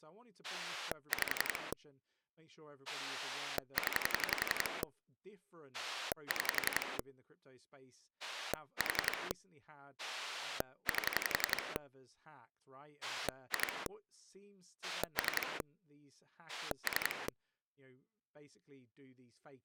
Pulse dialling, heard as a rotary dial, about 11 pulses a second, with speech in English. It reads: 5 0 6 4 8 2 3 3